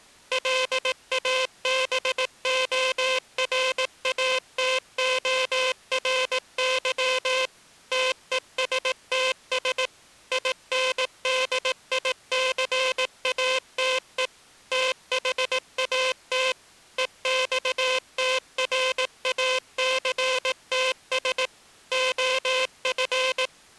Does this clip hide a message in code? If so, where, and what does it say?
Yes: Morse code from 0.3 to 23.5 s, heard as a buzzer, machine-sent, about 18 wpm. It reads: LABORATORY TESTS INDICATE THAT EXTRACTS OF